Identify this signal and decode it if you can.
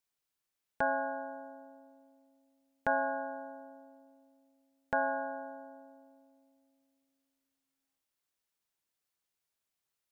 Clock strike, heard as a bell. 3. Three o'clock.